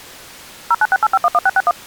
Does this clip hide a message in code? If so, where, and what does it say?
Yes: DTMF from 0.7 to 1.7 s, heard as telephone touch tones, dialled by machine, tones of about 40 ms. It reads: 0968511661